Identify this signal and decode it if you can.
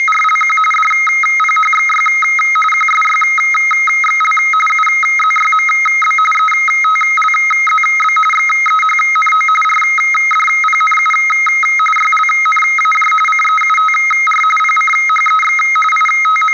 RTTY (45.45 baud, 850 Hz shift), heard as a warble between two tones, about 1700 Hz centre, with room echo. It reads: … DPHXY QSYXL UZYMB ETLZB XEHNO RDPNU YLNAJ CEUTR PCHEX …